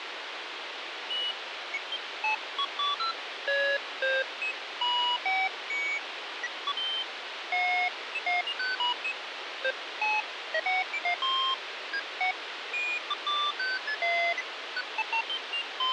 Electronic bleeps of random pitch and length, with radio hiss. There is no code.